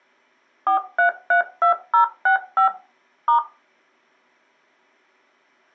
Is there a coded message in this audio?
Yes: DTMF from 0.7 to 3.4 s, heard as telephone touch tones, dialled by machine, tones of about 110 ms. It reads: 4332065 *